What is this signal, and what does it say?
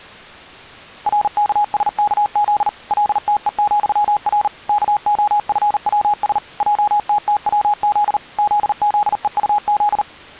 Morse code, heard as a keyed tone, machine-sent, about 39 wpm, 830 Hz. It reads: RKSKZ LTE,R KOFWS JTTWZ ZZEUZ